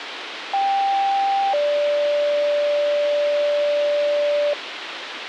Two-tone page, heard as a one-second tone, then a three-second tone, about 790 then 580 Hz, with radio hiss.